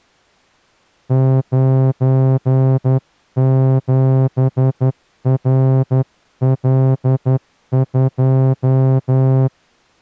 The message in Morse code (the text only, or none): 97RL2